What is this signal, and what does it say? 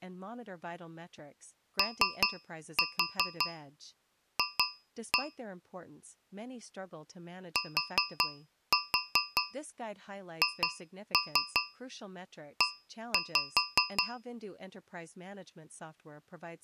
Tap code, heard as taps on a metal pipe, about 5 knocks a second, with speech in English. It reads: OF THE